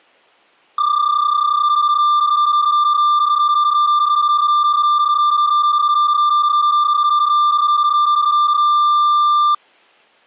PSK31 (31.25 baud), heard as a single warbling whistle, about 1190 Hz.